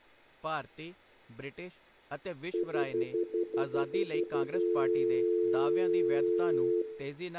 Telephone call progress tone (North American plan), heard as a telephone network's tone, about 350, 440 Hz, 0.1 s on and 0.1 s off, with room echo and speech in Punjabi. Stutter dial tone.